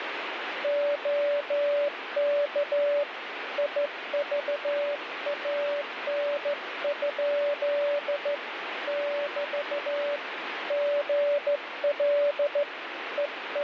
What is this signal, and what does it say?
Morse code, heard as a keyed tone, hand-sent with a straight key, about 14 wpm, 580 Hz, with radio static. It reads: OK IVAN? <BT> GL …